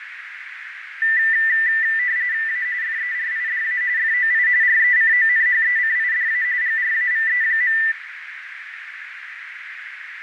RTTY (45.45 baud, 170 Hz shift), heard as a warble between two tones, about 1900 Hz centre, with radio static, fading and a narrow filter. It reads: A FERIDA FOI RECONHECIDA GRAVE.